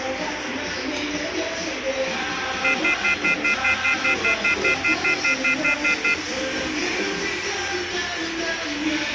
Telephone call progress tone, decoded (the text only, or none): off-hook warning tone